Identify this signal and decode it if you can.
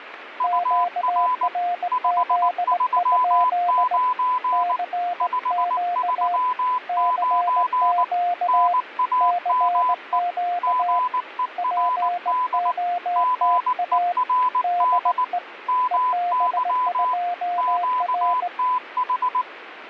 Morse code, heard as two keyed tones, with radio static. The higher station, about 19 wpm, 1000 Hz: UR 539 539 NAME GERD GERD MY QTH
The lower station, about 18 wpm, 710 Hz: QRZ? CQ CQ CQ POTA DE EB2R